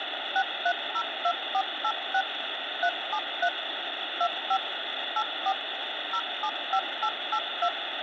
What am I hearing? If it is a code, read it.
DTMF, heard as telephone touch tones, dialled by machine, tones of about 70 ms, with phone line noise. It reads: 6302486 373 25 84 075882